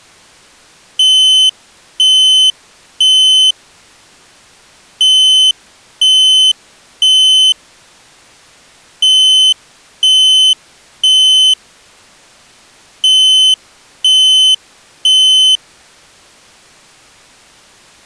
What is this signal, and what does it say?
Alarm pattern, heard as an alarm's beeps, played four times, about 3050 Hz. Temporal three. Smoke or fire, evacuate.